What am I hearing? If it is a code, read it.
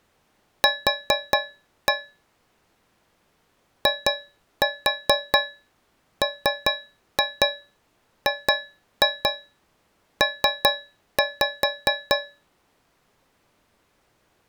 Tap code, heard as taps on a metal pipe, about 4 knocks a second. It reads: Q IMGP